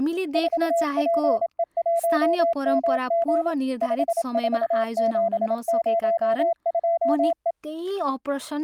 Morse code, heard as a keyed tone, machine-sent, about 27 wpm, 680 Hz, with speech in Nepali. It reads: 4PE1MG 54702E